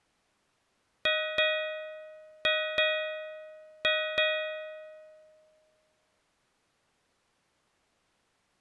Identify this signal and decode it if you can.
Ship's bell, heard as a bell. 6. Six half-hours of the watch have passed.